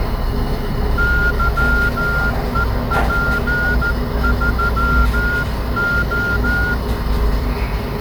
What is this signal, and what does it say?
Morse code, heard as a whistle, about 14 wpm, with the noise inside a lift. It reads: YEP3O